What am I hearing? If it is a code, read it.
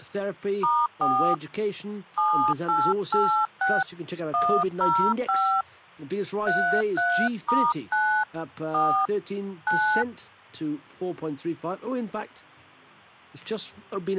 DTMF, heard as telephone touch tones, dialled by hand, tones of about 280 ms. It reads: *4 7886 105 33*9 4 9